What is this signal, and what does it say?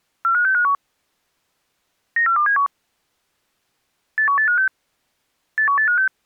Five-tone selective call (CCIR), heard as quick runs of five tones, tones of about 100 ms. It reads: 45651 94271 81856 81856